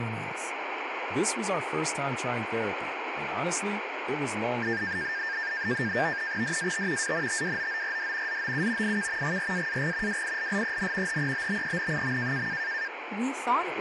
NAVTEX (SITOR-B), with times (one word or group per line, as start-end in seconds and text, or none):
6.4-7.1 DAT
7.0-8.4 ANTWOORD
8.3-9.0 ZOU
8.8-9.4 IK
9.2-10.2 GRAAG
10.1-11.2 WILLEN
11.1-12.5 HEBBEN.